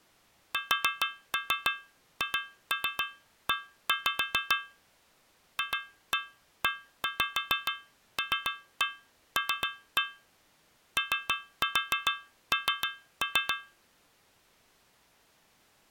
Tap code, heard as taps on a metal pipe, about 6 knocks a second. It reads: SHE FELL ON